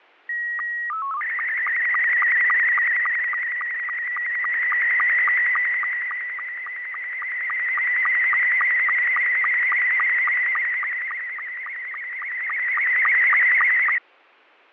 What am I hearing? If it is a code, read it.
SSTV (slow-scan television), Scottie S2, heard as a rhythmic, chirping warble, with fading.